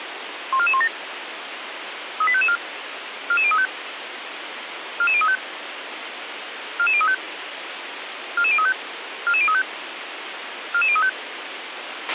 Five-tone selective call (ZVEI), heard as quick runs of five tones, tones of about 70 ms, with radio hiss and a squelch burst at the end. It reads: 14417 38554 44035 44035 44035 44035 44035 44035